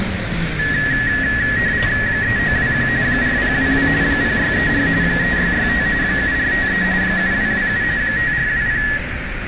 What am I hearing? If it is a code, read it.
RTTY (45.45 baud, 170 Hz shift), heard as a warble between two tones, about 1800 Hz centre, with radio static, a narrow filter, room echo and street noise. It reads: 3921 4022 0634 3665 7453 7227 5420